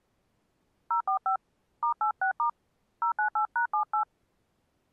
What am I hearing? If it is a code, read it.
DTMF, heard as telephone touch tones, dialled by hand, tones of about 100 ms. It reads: 045 *86* 098#78